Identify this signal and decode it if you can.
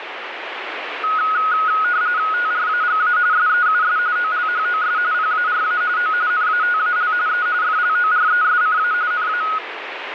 RTTY (45.45 baud, 170 Hz shift), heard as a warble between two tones, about 1360 Hz centre, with radio static. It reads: TRAGA SEUS OLHOS PARA O NATAL E FLORESCA NA